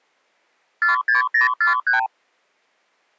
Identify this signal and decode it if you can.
Multi-frequency trunk signalling (R2, with the far end's replies), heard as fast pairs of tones, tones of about 130 ms. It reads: 46043